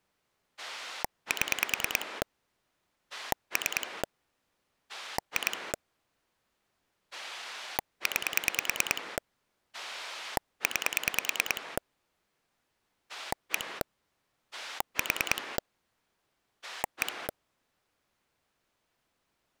Pulse dialling, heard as a rotary dial, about 9 pulses a second. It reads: 7 3 2 9 9 1 4 1